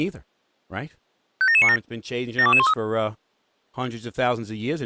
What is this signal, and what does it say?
Five-tone selective call (ZVEI), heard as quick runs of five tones, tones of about 70 ms, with speech in English. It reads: 57797 72213